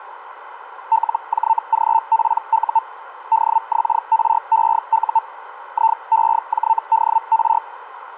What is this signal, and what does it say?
Hellschreiber (Feld-Hell, 122.5 baud), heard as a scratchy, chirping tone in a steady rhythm, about 900 Hz, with radio static. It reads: LJGPU DXREU IEJDR